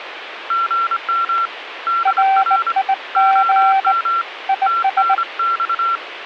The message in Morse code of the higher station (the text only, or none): GM DR OM TNX